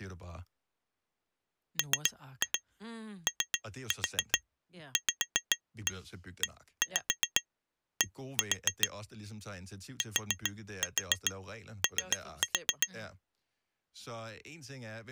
Tap code, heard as taps on glass, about 7 knocks a second, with speech in Danish. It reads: MOVED TO